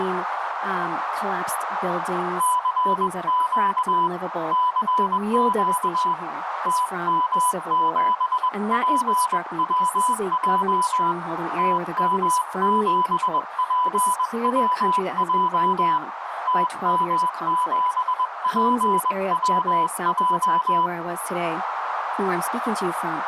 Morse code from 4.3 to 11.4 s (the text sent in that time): CQ TM7PWJ